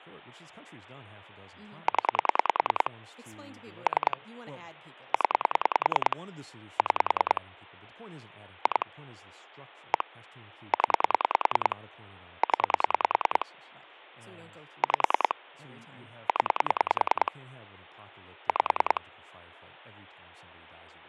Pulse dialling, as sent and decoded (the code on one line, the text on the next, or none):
10 / 3 / 10 / 6 / 2 / 1 / 10 / 10 / 5 / 10 / 5
0 3 0 6 2 1 0 0 5 0 5